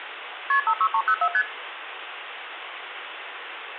Multi-frequency trunk signalling (R1, as on North American trunks), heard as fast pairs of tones, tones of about 70 ms, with phone line noise and room echo. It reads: KP 56304 ST